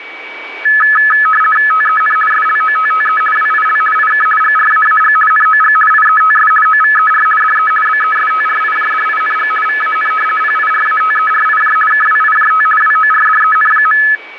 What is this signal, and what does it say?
RTTY (50 baud, 450 Hz shift), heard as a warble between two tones, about 1500 Hz centre, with radio static and a steady whistle near 2280 Hz. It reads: TEN SLOTTE WIL IK GRAAG NOG IETS OVER DE BESTRIJDING VAN PIRATERIJ KWIJT WORDEN.